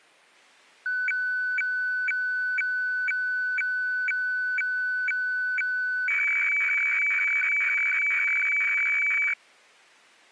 Weather fax (radiofax), 120 lines a minute, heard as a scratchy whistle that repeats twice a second.